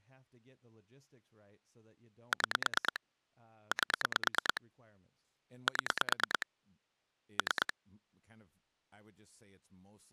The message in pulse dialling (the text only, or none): 6 8 7 3